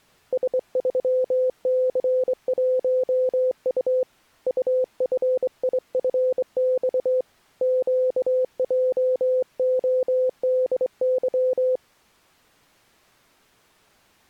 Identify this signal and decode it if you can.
Morse code, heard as a keyed tone, hand-sent with a straight key, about 24 wpm, 510 Hz. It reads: S3C1U UFIFX QJODY